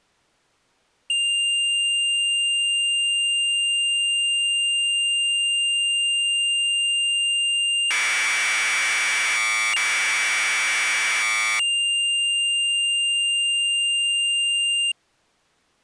Commodore tape loading (standard loader), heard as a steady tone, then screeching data.